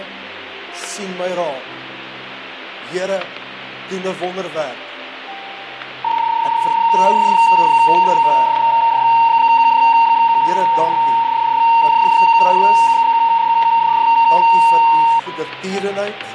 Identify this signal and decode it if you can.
PSK31 (31.25 baud), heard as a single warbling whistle, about 920 Hz, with static crashes.